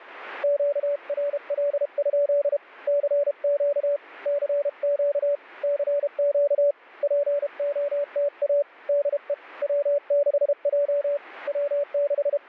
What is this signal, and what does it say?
Morse code, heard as a keyed tone, hand-sent with a paddle, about 32 wpm, 580 Hz. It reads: QRL? CQ CQ CQ POTA DE W6J …